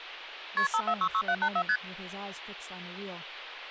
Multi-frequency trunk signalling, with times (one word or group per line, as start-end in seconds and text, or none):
0.6-0.7 KP
0.7-1.6 5466784
1.7-1.8 ST